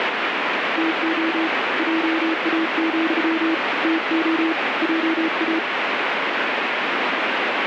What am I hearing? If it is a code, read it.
Morse code, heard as a keyed tone, hand-sent with a bug key, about 34 wpm, 320 Hz, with heavy radio static. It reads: TO JA, TO JA